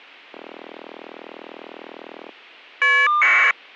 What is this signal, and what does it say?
Caller ID data burst, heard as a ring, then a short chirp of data, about 1200 baud.